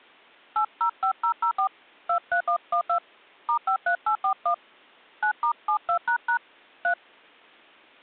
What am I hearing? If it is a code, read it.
DTMF, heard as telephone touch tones, dialled by hand, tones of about 90 ms. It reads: 805004 23112 *53841 9*72## 3